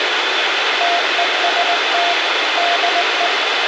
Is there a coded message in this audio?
Yes: Morse code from 0.7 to 3.3 s, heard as a keyed tone, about 19 wpm, 700 Hz, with radio hiss. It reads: TEST DE